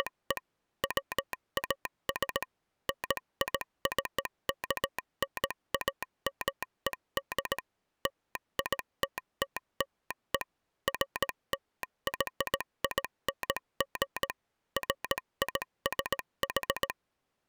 Morse code (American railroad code), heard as a telegraph sounder, machine-sent. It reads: … WAS NICKNAMED LITTLE FLYING FISH